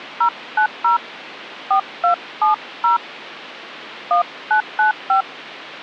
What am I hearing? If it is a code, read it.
DTMF, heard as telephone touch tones, dialled by hand, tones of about 120 ms. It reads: 090 4270 1995